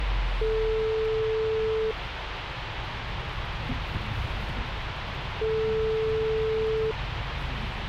Telephone call progress tone (single-tone plan, as in most of Europe), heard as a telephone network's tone, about 440 Hz, 1.5 s on and 3.5 s off, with phone line noise and the noise inside a bus. Ringback tone.